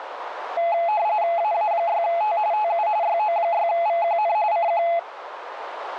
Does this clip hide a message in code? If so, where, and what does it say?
Yes: RTTY (45.45 baud, 170 Hz shift) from 0.6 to 5.0 s, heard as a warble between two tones, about 760 Hz centre, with radio static and a narrow filter. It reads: AA6T TU YO6VQN CQ